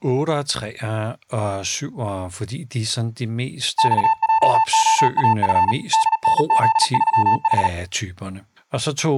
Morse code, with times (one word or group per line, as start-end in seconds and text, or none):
3.8-5.7 XJOAF
5.9-7.7 DNZ3H